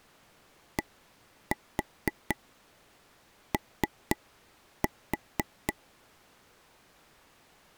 Tap code, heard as taps on a table, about 4 knocks a second. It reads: DO